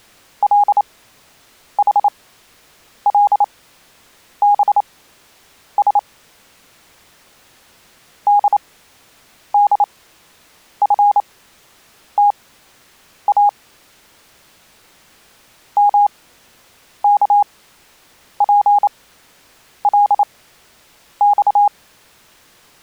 Morse code, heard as a keyed tone, machine-sent, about 28 wpm, spaced as for 8 wpm, 820 Hz. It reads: LHLBS DDFTA MKPLX